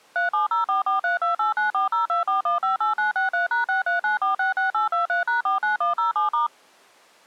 DTMF, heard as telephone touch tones, dialled by machine, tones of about 130 ms. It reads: 3704432894024158963#639466823#49107*